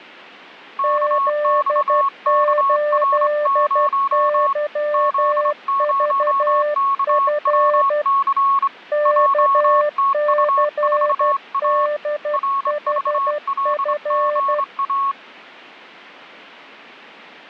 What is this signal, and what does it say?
Morse code, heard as two keyed tones, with radio static. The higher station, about 25 wpm, 1100 Hz: KXKR0 Z0KWC JTU4A RVLGA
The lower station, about 12 wpm, 590 Hz: Z8YVF KCDHF